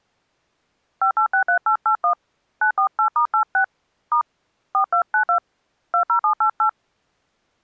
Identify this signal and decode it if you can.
DTMF, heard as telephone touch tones, dialled by hand, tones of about 100 ms. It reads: 5863881 948*86 * 4292 20788